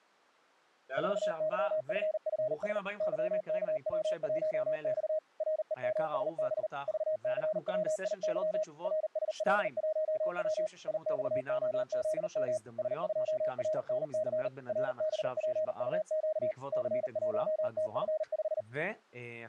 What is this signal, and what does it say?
Morse code, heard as a keyed tone, machine-sent, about 39 wpm, 620 Hz, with speech in Hebrew. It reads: 4YFFS YKW1X REMSB VCWIY RSL1W IXOZM S2RNC RBPUQ C1TF5